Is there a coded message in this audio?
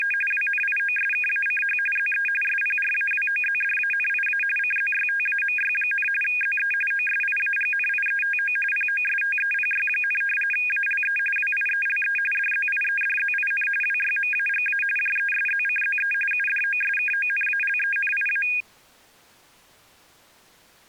Yes: RTTY (45.45 baud, 850 Hz shift) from 0.0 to 18.6 s, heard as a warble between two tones, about 2050 Hz centre. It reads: … WNIOSKACH ZE SPRAWOZDANIA CZYTAMY, ZE OSIAGNIETO POSTEPY, ALE WIELE DZIEDZIN WYMAGA JESZCZE UDOSKONALENIA